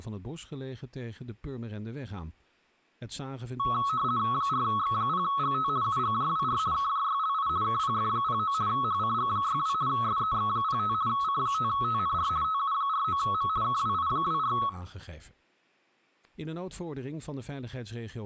RTTY (50 baud, 170 Hz shift), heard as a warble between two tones, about 1200 Hz centre, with speech in Dutch. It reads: 4X0GT UGJWR KJYLI KPF09 HCG62 SEX05 C5TNR TU49M KWI24